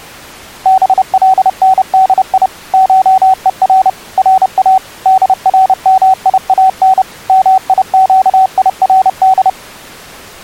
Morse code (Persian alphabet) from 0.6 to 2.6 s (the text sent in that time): بلندی